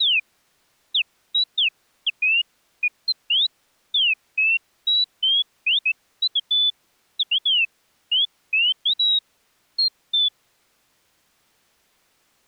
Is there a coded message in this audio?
No, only bird-like chirps.